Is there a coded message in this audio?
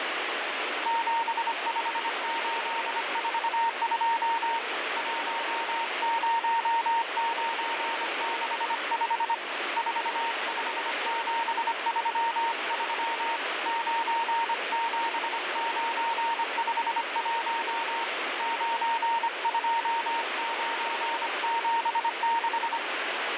Yes: Morse code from 0.8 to 22.8 s, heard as a keyed tone, hand-sent with a paddle, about 25 wpm, 920 Hz, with heavy radio static. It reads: 75842 10965 45733 97951 92976